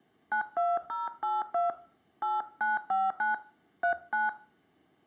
DTMF, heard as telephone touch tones, dialled by hand, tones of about 160 ms, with room echo. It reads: 92082 8959 39